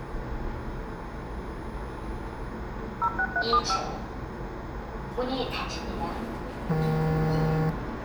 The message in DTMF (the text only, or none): 06375